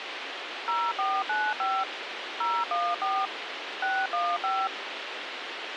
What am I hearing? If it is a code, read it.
DTMF, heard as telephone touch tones, dialled by machine, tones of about 240 ms, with radio hiss. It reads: 0495 014 615